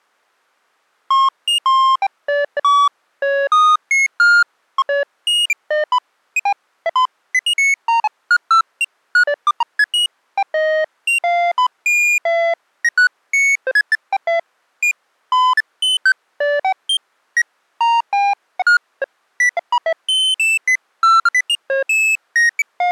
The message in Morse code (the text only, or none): none